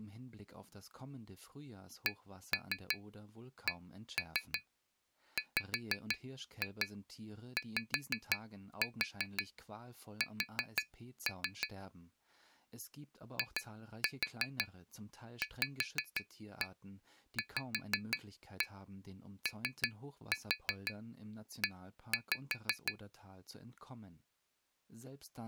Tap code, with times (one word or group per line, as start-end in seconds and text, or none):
2.1-11.7 CCWYS
13.4-22.9 IVVOE